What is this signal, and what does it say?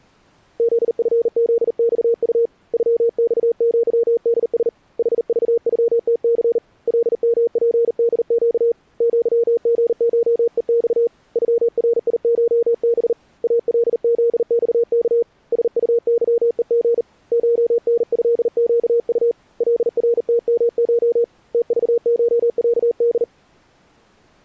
Morse code (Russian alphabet), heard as a keyed tone, hand-sent with a bug key, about 39 wpm, 470 Hz. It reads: ЗФЗЬУ ЮЬЪДС ХЖЮТЦ ЛМПДЩ ЪГШЕЬ ЮРИШБ АЛЗЬК СУЫЕГ ШНЭЩУ ЛРТМШ ТЖШЯД